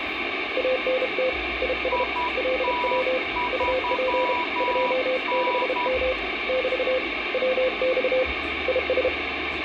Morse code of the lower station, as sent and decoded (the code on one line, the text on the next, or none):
.- -. - / .. ... / .-.. .-- / ..- .--. / ..--- -.... -- / -...- / .-- -..- / .. ...
ANT IS LW UP 26M <BT> WX IS